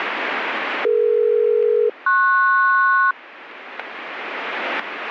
Aircraft SELCAL, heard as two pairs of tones, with radio static. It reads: DE-PS